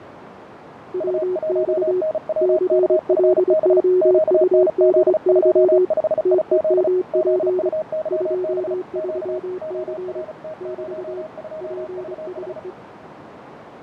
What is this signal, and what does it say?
Morse code, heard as two keyed tones, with radio static, fading and a narrow filter. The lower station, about 24 wpm, 370 Hz: WX CLOUDY TEMP 23C <BT> PSE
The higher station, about 35 wpm, 630 Hz: U1NWKFB QNZ25IZ ZUYB Q ORT02VH